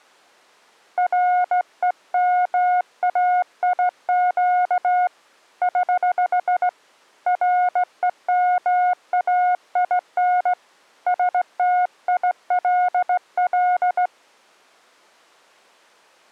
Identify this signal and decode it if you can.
Morse code, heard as a keyed tone, hand-sent with a straight key, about 17 wpm, 720 Hz. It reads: REMAIQ <HH> REMAIN STILL